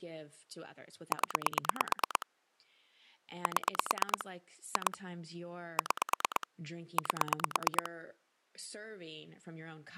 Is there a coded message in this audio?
Yes: pulse dialling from 1.1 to 7.9 s, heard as clicks on a phone line, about 9 pulses a second, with speech in English. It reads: 0 7 2 6 8